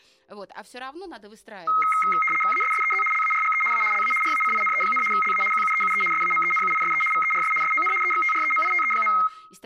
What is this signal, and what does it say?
RTTY (75 baud, 850 Hz shift), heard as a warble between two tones, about 1700 Hz centre, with room echo and speech in Russian. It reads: ASSEZ LARGE A LA RACINE, LA QUEUE SAMENUISE VERS SON EXTREMITE.